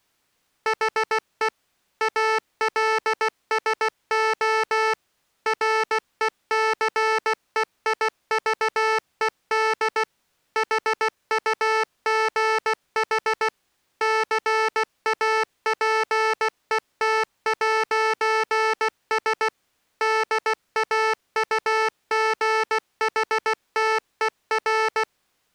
Morse code, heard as electronic beeps, machine-sent, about 16 wpm, 440 Hz. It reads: HE ALSO RECEIVED HUGH CAPET'S DAUGHTER